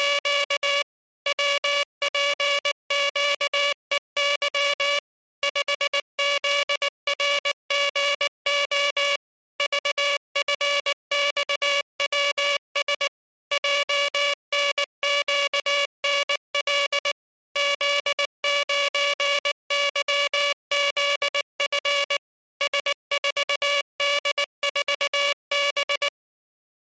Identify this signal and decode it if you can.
Morse code, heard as a buzzer, machine-sent, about 19 wpm. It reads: … WPQEY 5ZRGO VFXWS JNQNL Z9YZF S4D4B